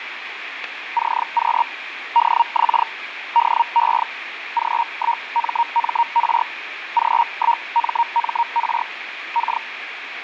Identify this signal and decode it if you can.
Hellschreiber (Feld-Hell, 122.5 baud), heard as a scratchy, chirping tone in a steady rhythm, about 940 Hz, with radio static. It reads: CQ DX DE G1MMR G1MMR K